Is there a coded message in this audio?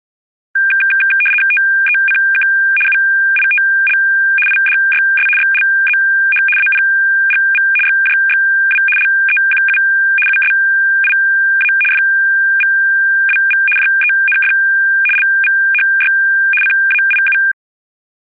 Yes: RTTY (75 baud, 850 Hz shift) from 0.6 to 17.5 s, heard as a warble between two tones, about 2000 Hz centre. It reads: TECK UITL IDYS XLZH APGV XJXW LEQU USIA FVWV JENF LVHY CAIU